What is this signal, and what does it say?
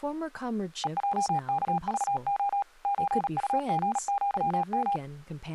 Morse code (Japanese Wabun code), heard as a keyed tone, machine-sent, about 37 wpm, 800 Hz, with speech in English. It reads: ヘヲワクレ ソウリアヨ